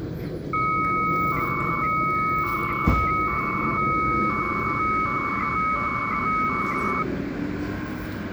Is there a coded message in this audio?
Yes: 300-baud modem data (Bell 103 tones) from 0.5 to 7.0 s, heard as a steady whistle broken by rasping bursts, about 300 baud, 200 Hz shift, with the noise of a residential street.